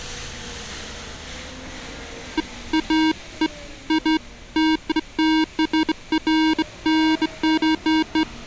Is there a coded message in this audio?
No, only beeps of irregular length, with street noise.